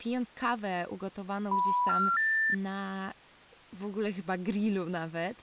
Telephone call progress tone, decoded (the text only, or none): special information tone